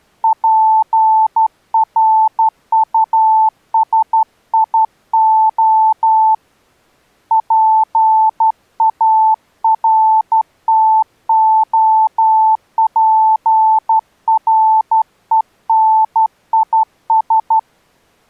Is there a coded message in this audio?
Yes: Morse code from 0.2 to 17.7 s, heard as a keyed tone, hand-sent with a straight key, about 12 wpm, 880 Hz. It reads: PRUSIO PARTOPRENIS